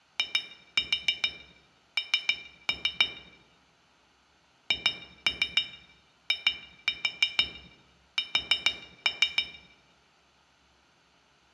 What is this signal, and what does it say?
Tap code, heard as taps on glass, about 6 knocks a second, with room echo. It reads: IN HIS